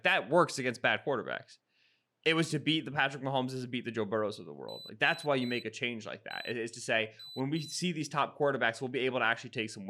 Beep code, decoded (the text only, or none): 3-1-2